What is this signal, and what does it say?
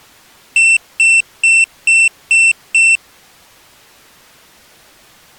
Beep code, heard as a piezo beeper, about 2700 Hz. 6 short. In AMI BIOS tables: keyboard controller gate A20 failure; in Dell tables: video card failure.